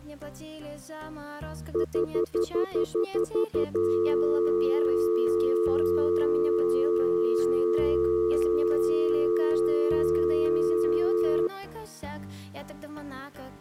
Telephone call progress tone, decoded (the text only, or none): stutter dial tone